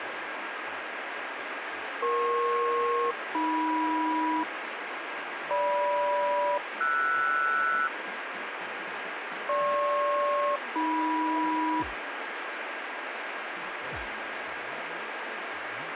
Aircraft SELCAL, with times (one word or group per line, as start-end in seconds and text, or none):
2.0-4.4 EP-AM
5.5-7.9 GM-RS
9.5-11.8 GP-AM